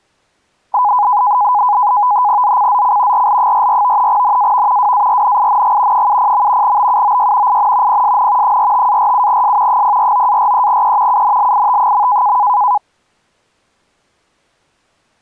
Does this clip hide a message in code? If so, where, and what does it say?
Yes: NAVTEX (SITOR-B), 100 baud, 170 Hz shift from 0.7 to 12.8 s, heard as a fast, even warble, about 910 Hz centre. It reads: ZCZC RL44 NAV WARNING 70. BUOY IN PSN 45-47S 049-43E UNLIT.